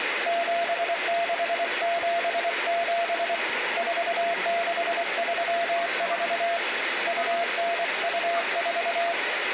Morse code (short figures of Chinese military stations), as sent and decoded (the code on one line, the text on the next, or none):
--... -.... --... --... / ....- -.... ...-- ....- / ..- -. ..- ....-
7677 4634 2924